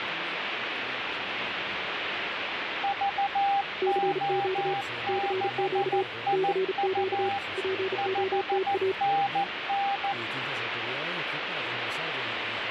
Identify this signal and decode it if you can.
Morse code, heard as two keyed tones, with radio static. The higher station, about 14 wpm, 800 Hz: VO6IU 5NN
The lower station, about 35 wpm, 380 Hz: CQ CQ CQ POTA